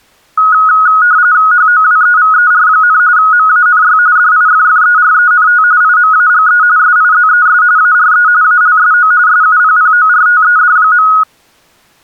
RTTY (45.45 baud, 170 Hz shift), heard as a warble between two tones, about 1360 Hz centre. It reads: HOWEVER, MANY DIFFERENT IMAGE SIZES ARE ALSO SUPPORTED.